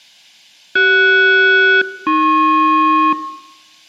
Aircraft SELCAL, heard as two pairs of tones. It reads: CS-AP